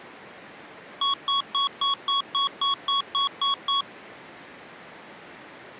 Beep code, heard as beeps from a small speaker, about 1110 Hz. 11 short. In AMI BIOS tables: cache memory error.